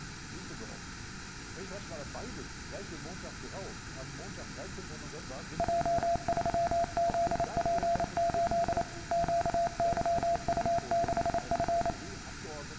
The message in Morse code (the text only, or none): J3ZP8 QYU6F